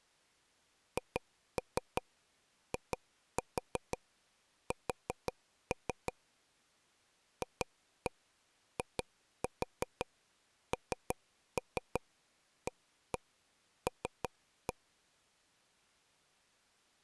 Tap code, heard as taps on a table, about 5 knocks a second. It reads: HIS FINAL